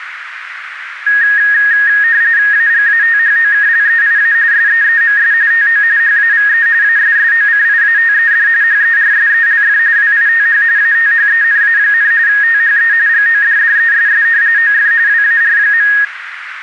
RTTY (45.45 baud, 170 Hz shift), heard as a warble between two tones, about 1750 Hz centre, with radio static and a narrow filter. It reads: AGATHOKLEIA SEEMS TO HAVE ASSOCIATED HERSELF WITH ATHENA, THE GODDESS OF WAR.